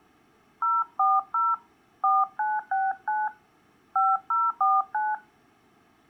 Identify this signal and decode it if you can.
DTMF, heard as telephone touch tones, dialled by hand, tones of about 200 ms. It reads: 040 4969 5049